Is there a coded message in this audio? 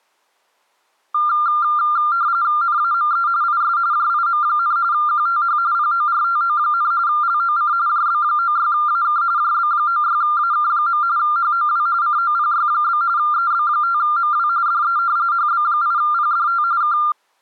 Yes: RTTY (45.45 baud, 170 Hz shift) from 1.1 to 17.1 s, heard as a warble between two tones, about 1290 Hz centre. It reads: NAME IS JIM, QTH PORTO, LOC JB96AK JB96AK. HOW COPY? EB5MW DE HB8PDT K